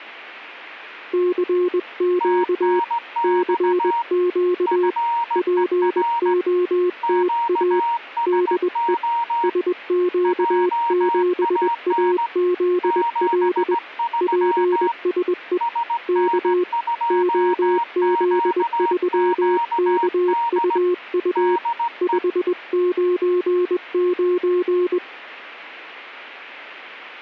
Morse code, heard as two keyed tones. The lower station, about 21 wpm, 360 Hz: CQ CQ POTA DE SQ7AZL PSE K OZ3KUU 599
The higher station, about 17 wpm, 940 Hz: TNX FER QSO JAN 73 SN2QQD DE